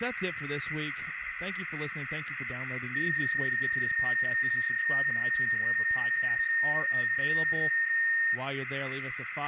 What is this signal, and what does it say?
PSK31 (31.25 baud), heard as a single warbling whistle, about 1850 Hz, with radio static, a narrow filter and speech in English.